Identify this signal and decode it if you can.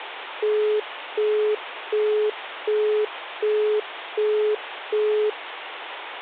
Telephone call progress tone (as in the UK, Australia and similar networks), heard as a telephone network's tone, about 420 Hz, 0.375 s on and 0.375 s off, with phone line noise. Busy tone.